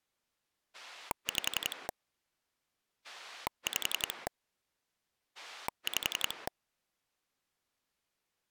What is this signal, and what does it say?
Pulse dialling, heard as a rotary dial, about 11 pulses a second. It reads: 5 5 5